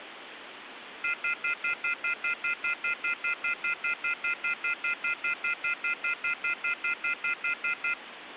Telephone call progress tone (North American plan), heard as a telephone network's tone, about 1400, 2050, 2450, 2600 Hz, 0.1 s on and 0.1 s off, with phone line noise. Off-hook warning tone.